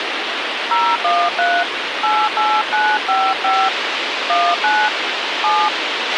DTMF, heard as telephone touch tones, dialled by hand, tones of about 250 ms, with radio hiss and a squelch burst at the end. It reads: 013 88955 19 7